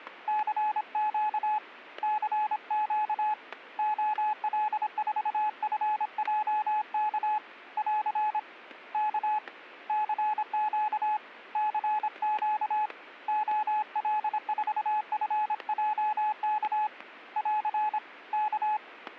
Morse code, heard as a keyed tone, hand-sent with a paddle, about 26 wpm, 850 Hz, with static crashes. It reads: CQ CQ OL4FJK <AR> K CQ CQ OL4FJK <AR> K